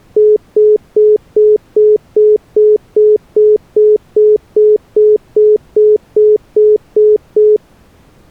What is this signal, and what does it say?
Telephone call progress tone (single-tone plan, as in most of Europe), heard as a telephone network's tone, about 420 Hz, 0.2 s on and 0.2 s off. Congestion tone.